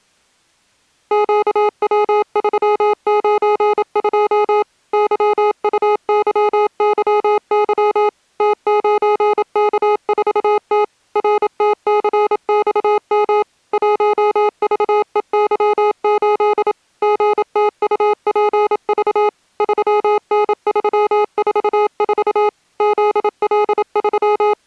Morse code, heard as electronic beeps, machine-sent, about 27 wpm, 420 Hz. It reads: QW392 YUYYY T9K4T RTCXM 1VEY8 GTUPV 3N344 …